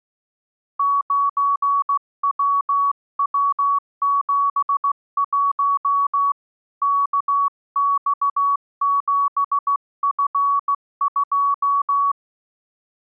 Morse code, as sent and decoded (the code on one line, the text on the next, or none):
----. .-- .-- --... .---- / -.- -..- --... ..-. ..---
9WW71 KX7F2